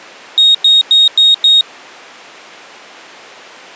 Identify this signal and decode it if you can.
Beep code, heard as a piezo beeper, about 3750 Hz. 5 short. In AMI BIOS tables: processor failure; in Dell tables: CMOS battery failure.